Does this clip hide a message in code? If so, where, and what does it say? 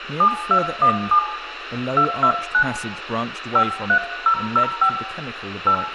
Yes: DTMF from 0.2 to 5.7 s, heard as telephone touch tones, dialled by hand, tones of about 80 ms, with radio hiss, room echo and speech in English. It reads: 7217 229 53005 8